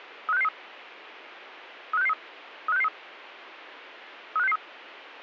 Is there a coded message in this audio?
Yes: five-tone selective call (EEA) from 0.3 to 4.6 s, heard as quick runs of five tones, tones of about 40 ms. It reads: 35663 35663 35663 35663